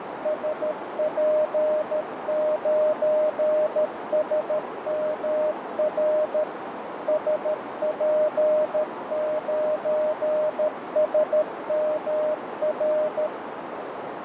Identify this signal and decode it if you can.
Morse code, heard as a keyed tone, machine-sent, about 13 wpm, 610 Hz, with radio static and a narrow filter. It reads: SP9SMR SP9SMR